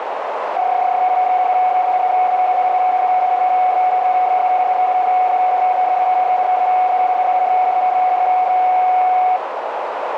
PSK31 (31.25 baud), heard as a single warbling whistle, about 740 Hz, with radio static and a narrow filter.